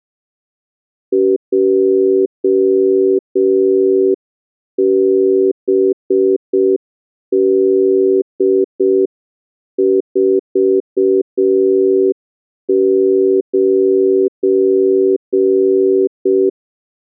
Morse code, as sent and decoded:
.--- -... -.. ....- ----.
JBD49

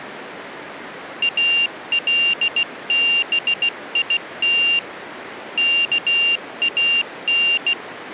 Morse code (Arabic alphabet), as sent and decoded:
.- .-.. -... .. - / -.- .- -.
البيت كان

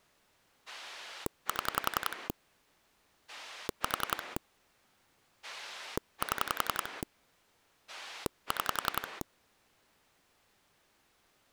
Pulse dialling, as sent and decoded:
7 / 4 / 7 / 6
7 4 7 6

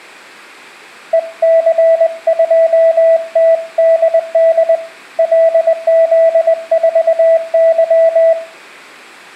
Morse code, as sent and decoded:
. -.-. ..--- - -.. -.. / .-.. --.. ....- -.--
EC2TDD LZ4Y

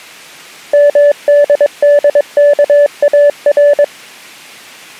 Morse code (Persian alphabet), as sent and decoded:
-- -.. -.. -.- .- .-.
مددکار

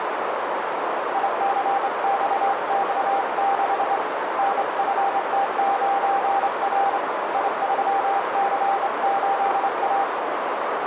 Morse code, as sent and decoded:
.. -.-. -..- -..- -.... / -. ..-. - ----. .-. / .. ...-- -.-. ---.. .-
ICXX6 NFT9R I3C8A

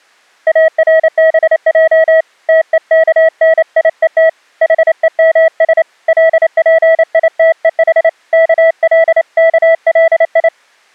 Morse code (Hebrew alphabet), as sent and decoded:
.- .-. -... .--- / - . -.- -. .. . - / .... . -- ... / .-.. .--. .. - . .... / -.- .-.. -.- .-.. ..
ארבע תוכניות חומש לפיתוח כלכלי

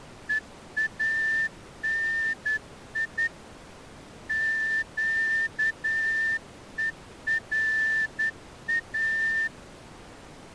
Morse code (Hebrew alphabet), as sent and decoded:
. .- -. .. / --.- . .-. .-
ואני קורא

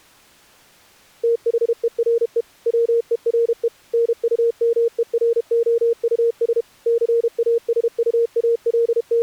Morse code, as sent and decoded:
- .... . .-. . / .-- . .-. . / -. ..- -- . .-. --- ..- ... / …
THERE WERE NUMEROUS …

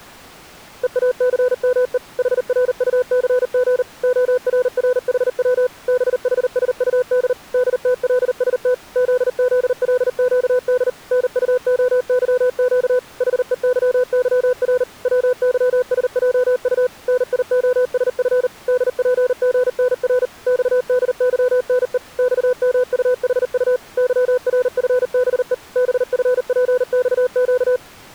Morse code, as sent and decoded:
. .- -.-. -- . / .... .-. ..- -.-. --. / --- .-. .-. .... .-- / -... .... ... ..- -.. / -.. - .-.. ... - / --.. --.. .-.. --.- -.. / -. ..- --- -.-- --.- / .... . -.-- -.-- .-. / .-- -.-- ... .--- ..- / -. .. --- ... ..-. / -.. .--. --. -. .-. / -..- -.. -.-- -. . / -..- -- ..- .... ..- / -.-- .-. ..-. -... . / -... ..-. .--. -..- --.-
EACME HRUCG ORRHW BHSUD DTLST ZZLQD NUOYQ HEYYR WYSJU NIOSF DPGNR XDYNE XMUHU YRFBE BFPXQ

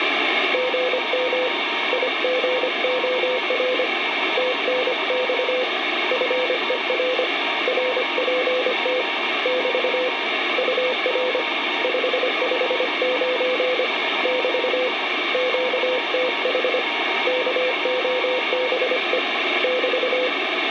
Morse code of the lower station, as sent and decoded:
--. -- / .. --. --- .-. / - -. -..- / ..-. . .-. / .-. .--. - / -...- / ..- .-. / ..... ..... ----. / -...- / --.- - .... / -.- --- -... . / -...-
GM IGOR TNX FER RPT <BT> UR 559 <BT> QTH KOBE <BT>

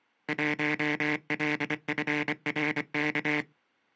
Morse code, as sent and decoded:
.---- .-.. ..-. .-. -.-
1LFRK

